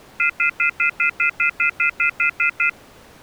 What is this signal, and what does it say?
Telephone call progress tone (North American plan), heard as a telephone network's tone, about 1400, 2050, 2450, 2600 Hz, 0.1 s on and 0.1 s off. Off-hook warning tone.